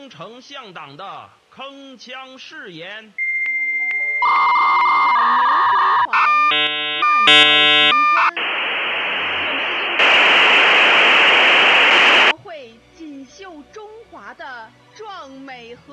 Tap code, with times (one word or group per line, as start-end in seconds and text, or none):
none